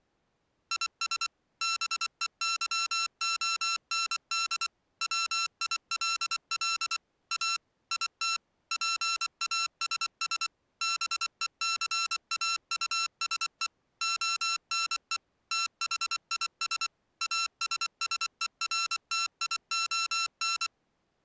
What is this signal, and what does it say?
Morse code, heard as electronic beeps, machine-sent, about 24 wpm, 1350 Hz. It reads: IS BEYOND WILL A IT PASS BECAUSE ONE THIS ASSERTION